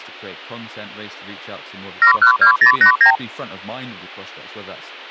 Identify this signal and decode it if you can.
Multi-frequency trunk signalling (R2, with the far end's replies), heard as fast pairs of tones, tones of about 100 ms, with speech in English. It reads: 712089